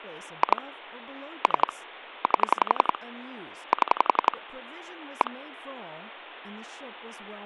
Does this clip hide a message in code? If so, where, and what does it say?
Yes: pulse dialling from 0.4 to 5.3 s, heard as clicks on a phone line, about 11 pulses a second, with speech in English. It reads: 2 3 8 7 1